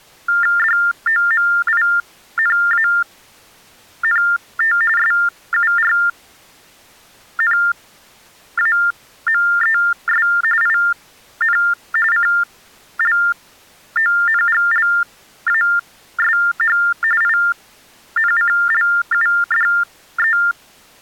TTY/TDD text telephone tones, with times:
0.6-4.8 DOMINANT
5.0-10.3 SURNAMES
10.6-11.6 IN
12.1-16.8 CLONGLASH
17.2-20.4 INCLUDE

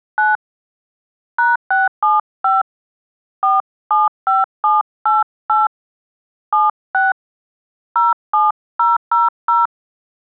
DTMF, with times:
0.2-0.4 9
1.4-2.6 #675
3.4-5.7 475788
6.5-7.1 76
8.0-9.7 07000

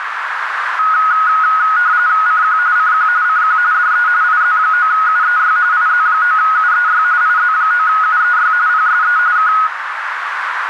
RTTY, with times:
2.3-2.6 CQ
2.8-3.1 CQ
3.2-3.6 CQ
3.7-4.1 DE
4.2-5.6 IZ9UEY
5.7-7.0 IZ9UEY
7.2-8.5 IZ9UEY
8.7-9.2 PSE
9.4-9.5 K

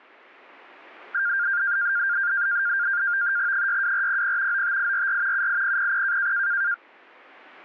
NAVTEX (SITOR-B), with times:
3.5-4.6 62400
4.5-5.5 95844
5.3-6.3 78000

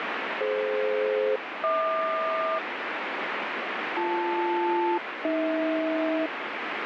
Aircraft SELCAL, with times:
0.4-2.6 DF-HQ
4.0-6.3 BL-AH

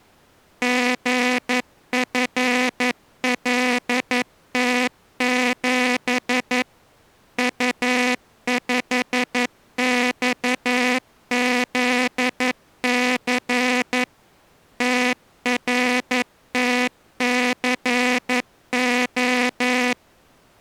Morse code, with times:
0.6-6.6 GFLT7
7.4-14.0 U5XZC
14.8-19.9 TRTCO

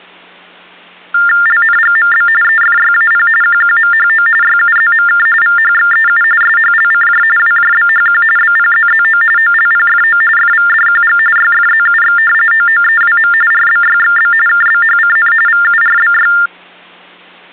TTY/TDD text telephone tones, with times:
1.5-2.3 LNGMB
2.4-3.3 EFYAP
3.4-4.3 QQMHO
4.4-5.3 YUZMK
5.4-6.2 VHXEU
6.4-7.2 SHLCJ
7.4-8.2 WJBHQ
8.4-9.2 BPZZO
9.4-10.2 OLPFO
10.4-11.2 FVDQG
11.4-12.2 YFZUX
12.5-13.3 OOEWM
13.5-14.3 RBYXB
14.5-15.3 KBHCN
15.5-16.3 VURBY

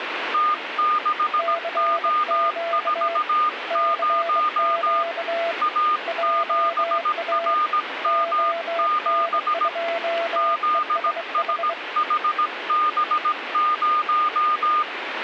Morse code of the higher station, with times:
0.3-5.0 T6O40
5.6-9.7 A7RM7
10.4-14.8 ZSHB0

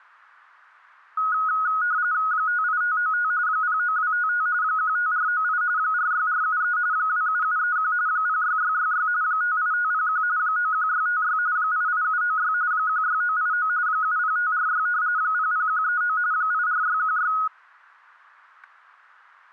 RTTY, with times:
2.3-3.3 58595
3.5-4.5 09255
4.6-5.6 15498
5.8-6.8 46473
6.9-7.9 27731
8.1-9.1 06666
9.2-10.2 58501
10.4-11.4 91656
11.6-12.5 88796
12.7-13.7 16989
13.9-14.9 70546
15.2-16.2 00139
16.3-17.3 84616

